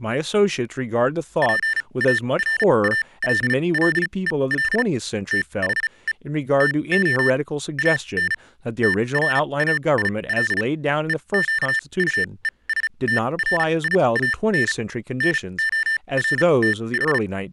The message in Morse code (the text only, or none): PARALLEL THE TO AN TRAIL EQUESTRIAN NORTH